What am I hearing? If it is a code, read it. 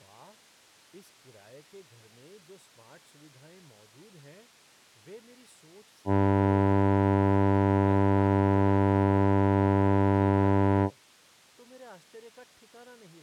Ship horn signal, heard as a ship's horn, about 100 Hz, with speech in Hindi. 1 long. At sea: a vessel nearing a blind bend, or under power and making way in fog.